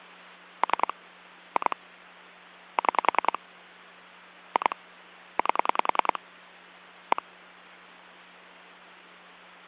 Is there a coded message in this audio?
Yes: pulse dialling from 0.6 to 7.2 s, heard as clicks on a phone line, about 10 pulses a second, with hum. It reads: 3 2 6 2 8 1